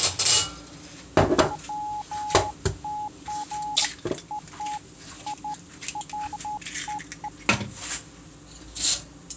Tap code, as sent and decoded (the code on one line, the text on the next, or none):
none